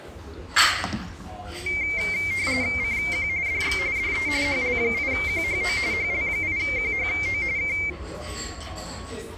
RTTY (45.45 baud, 170 Hz shift), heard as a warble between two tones, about 2200 Hz centre, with the noise of a restaurant. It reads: CQ DX DE HL8QHO HL8QHO K